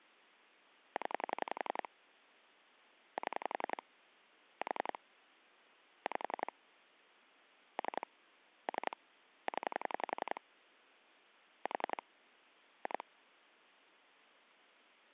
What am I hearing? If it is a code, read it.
Pulse dialling, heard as clicks on a phone line, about 11 pulses a second. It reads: 0 7 4 5 3 3 0 4 2